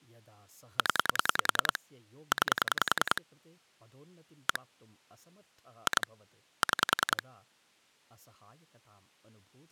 Pulse dialling, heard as clicks on a phone line, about 10 pulses a second, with speech in Sanskrit. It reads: 0 9 1 2 6